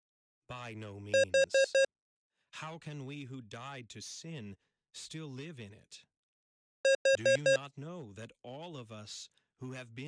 Alarm pattern, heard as an alarm's beeps, played twice, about 540 Hz, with speech in English. Temporal four. Carbon monoxide.